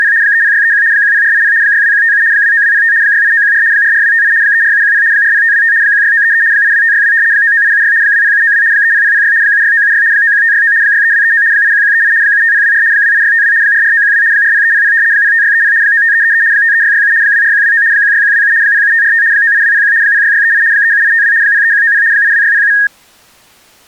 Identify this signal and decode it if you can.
RTTY (75 baud, 170 Hz shift), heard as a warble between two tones, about 1750 Hz centre. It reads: … 30631 10480 62157 29205 68914 44258 34710 40525 16933 82562 99876 20792 30006 76976 91569 63239 81138 75024 28652 44912 40300 05630 95333 53667 24129 16127 07545 98201 06638 37852 03190 82607